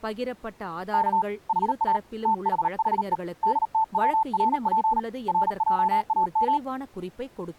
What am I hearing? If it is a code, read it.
Morse code, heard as a keyed tone, hand-sent with a paddle, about 38 wpm, 880 Hz, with speech in Tamil. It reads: K HA THHE DTWRP RJAM